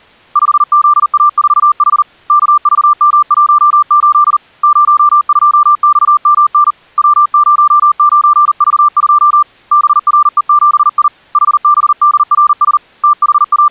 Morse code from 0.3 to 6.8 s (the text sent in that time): 5ZA4H KVM18 02XMN